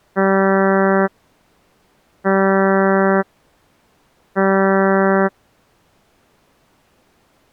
Ship horn signal, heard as a ship's horn, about 190 Hz. 3 short. At sea: I am operating astern propulsion.